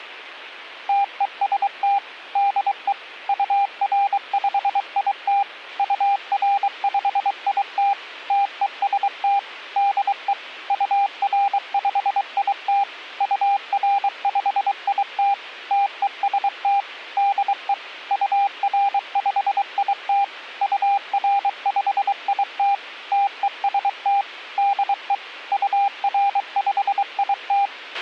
Morse code, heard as a keyed tone, machine-sent, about 23 wpm, 800 Hz, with a squelch burst at the end. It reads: TEST DE UR5IT UR5IT TEST DE UR5IT UR5IT TEST DE UR5IT UR5IT TEST DE UR5IT